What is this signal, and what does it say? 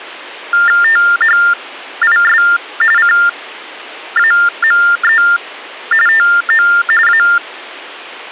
TTY/TDD text telephone tones (45.45 baud Baudot), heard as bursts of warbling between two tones, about 400 Hz shift, 1600 Hz centre. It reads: THIS CAME TO A